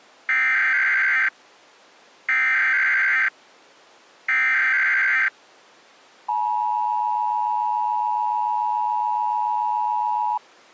Emergency Alert System (SAME) tones (header bursts, then the 853 and 960 Hz attention tone), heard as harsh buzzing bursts, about 520.83 baud.